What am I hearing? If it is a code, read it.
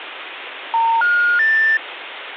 Telephone call progress tone (North American plan), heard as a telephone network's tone, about 910, 1430, 1800 Hz, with phone line noise. Special information tone.